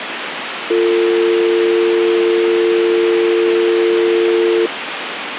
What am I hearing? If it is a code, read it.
Telephone call progress tone (North American or UK plan), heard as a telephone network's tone, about 350, 450 Hz, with phone line noise. Dial tone.